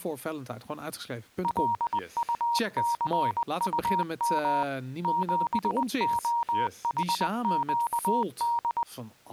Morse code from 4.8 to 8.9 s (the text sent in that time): 7OHQD